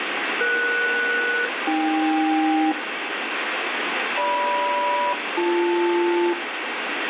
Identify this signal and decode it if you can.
Aircraft SELCAL, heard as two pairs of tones, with radio static and room echo. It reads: ES-AK GM-BL